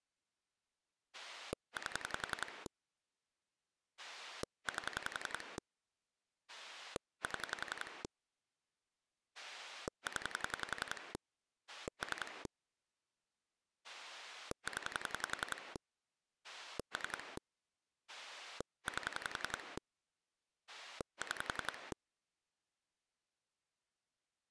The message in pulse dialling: 8 8 7 0 3 0 3 8 6

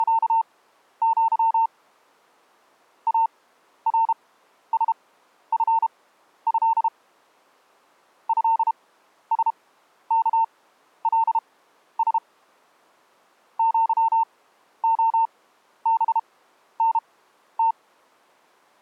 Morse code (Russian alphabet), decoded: … АРСФЭ ЭСКЛС ЪОБНТ

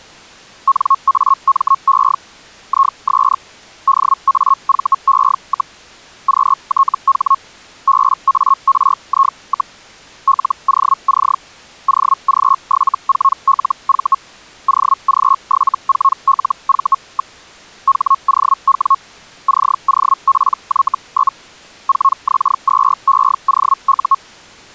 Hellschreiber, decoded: NAME IS DAVE, QTH BARI, LOC OG74LV OG74LV. HOW COPY? 4X2EOU

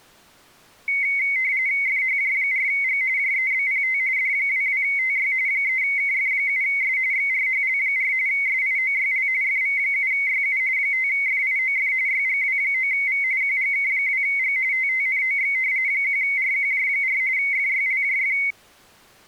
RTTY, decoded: FHJ4G JEBPT D22TY 3KF7S XRHL4 SIOYL FV7YU 5FIOF YGW9V QGK2G TTNOX 1RQJ4 FYLJF

